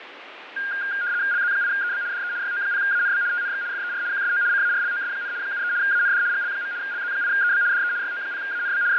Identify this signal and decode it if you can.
RTTY (75 baud, 170 Hz shift), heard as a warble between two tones, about 1500 Hz centre, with radio static and fading. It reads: LZ8EB DE YO0ANB TNX FER QSO CARLOS, 73 AND GL. LZ8EB DE YO0ANB …